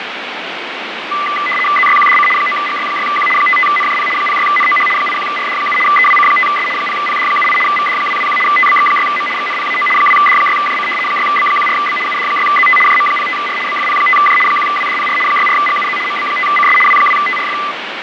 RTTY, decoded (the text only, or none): ZYQDC 9GY6Q 55NJP 06NOH 81RD7 EWC5S 0PD78 VD221 TBX6M XNPAO 2D6JC 6B14B UD6ZT JM05R BFP5J 1WDPR 64GUZ MB5CS W2TRF